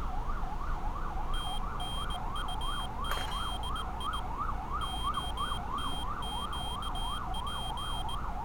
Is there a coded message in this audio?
Yes: Morse code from 1.3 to 8.2 s, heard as a high beeper, hand-sent with a bug key, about 19 wpm, 3200 Hz, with street noise. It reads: TNUZI OTQP